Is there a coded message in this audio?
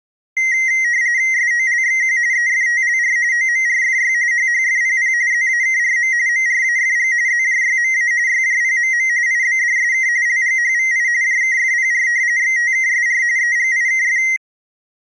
Yes: RTTY (45.45 baud, 170 Hz shift) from 0.4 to 14.4 s, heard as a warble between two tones, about 2000 Hz centre. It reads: SOLXQ EFTLR OMRFY HHFPP ZAKRM MRAFG ZJYMA YJPMM IBDSK LGHVI JKFPR XTKSR EGIKF